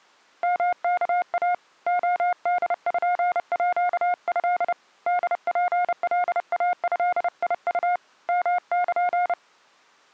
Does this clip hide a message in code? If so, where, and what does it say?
Yes: Morse code (Japanese Wabun code) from 0.4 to 9.4 s, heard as a keyed tone, hand-sent with a paddle, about 30 wpm, 710 Hz. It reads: ヨワイ レポート ホツカイドウ ヨル